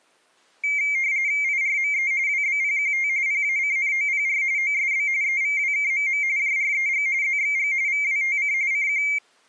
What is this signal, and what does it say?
RTTY (45.45 baud, 170 Hz shift), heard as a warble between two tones, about 2200 Hz centre. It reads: IRME WBPQT PACNOPR OSB EVWKMM JREG ZXG VWTC CQ